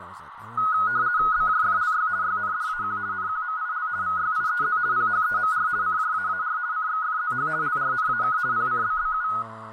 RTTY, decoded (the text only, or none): BJFLY YNDAQ NQMIL VYIEZ PHEMR CJAAR CXFZH LRNAK PCBBU